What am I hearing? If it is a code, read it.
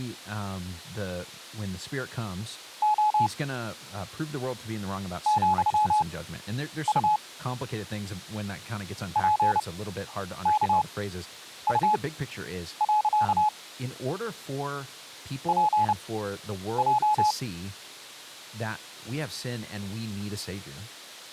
Morse code, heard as a keyed tone, machine-sent, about 30 wpm, spaced as for 9 wpm, 850 Hz, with speech in English. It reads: O ,U PKU. PJ